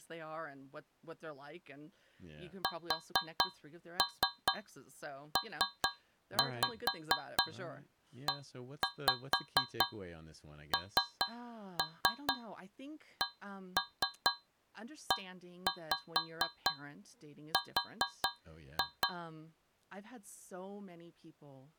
Tap code, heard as taps on a metal pipe, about 4 knocks a second, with speech in English. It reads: SPENCER